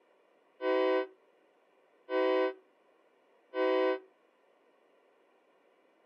Train horn signal, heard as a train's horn. 3 short. On North American railways: when stopped, the train will back up.